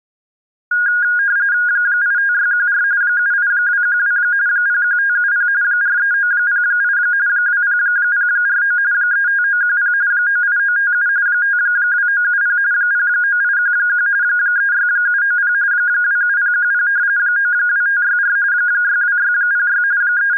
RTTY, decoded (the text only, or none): 85614 78212 01570 43908 20049 35910 98957 52970 09811 36790 27010 92564 62606 …